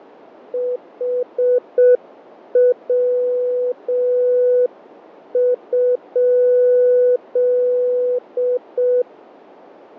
Morse code, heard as a keyed tone, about 6 wpm, 500 Hz, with radio static and fading. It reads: HW?